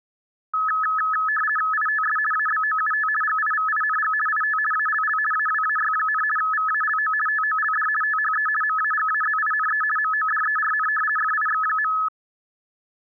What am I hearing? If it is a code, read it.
RTTY (50 baud, 450 Hz shift), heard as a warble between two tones, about 1500 Hz centre. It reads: ITS ABOUT GIVING IT ALL AWAY, VALO TOLD THE MAGAZINE MODERN FIX.